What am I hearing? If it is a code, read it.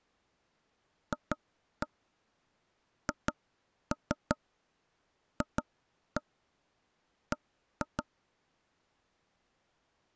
Tap code, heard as taps on a table, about 5 knocks a second. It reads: FHFB